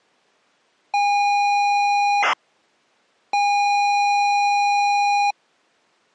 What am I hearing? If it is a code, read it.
ZX Spectrum tape loading, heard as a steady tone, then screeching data.